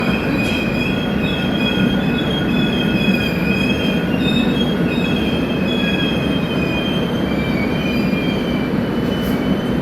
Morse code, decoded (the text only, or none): none